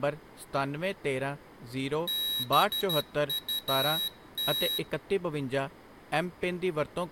Morse code, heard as a high beeper, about 12 wpm, 3850 Hz, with room echo and speech in Punjabi. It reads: BUT